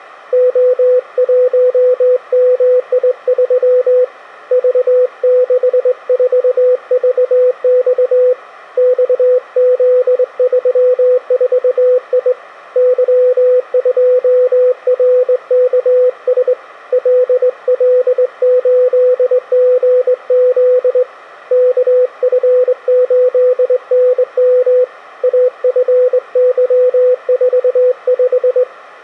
Morse code, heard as a keyed tone, hand-sent with a straight key, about 21 wpm, 500 Hz. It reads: O1MI3 V64VX XZ34I Y2RKS LL8GZ KF8NM AFY45